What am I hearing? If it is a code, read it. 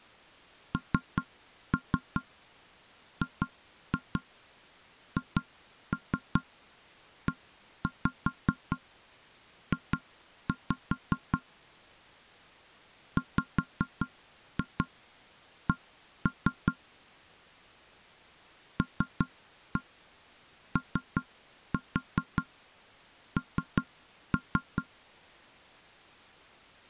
Tap code, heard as knocks on wood, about 5 knocks a second. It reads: NGHEJ WC LON